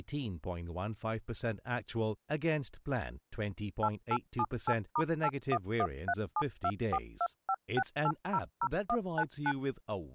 DTMF, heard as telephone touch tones, dialled by machine, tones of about 60 ms, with speech in English. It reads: 8878*8113724256800199